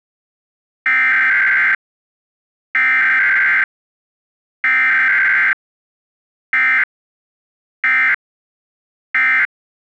Emergency Alert System (SAME) tones (header bursts, then end-of-message bursts), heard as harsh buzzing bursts, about 520.83 baud.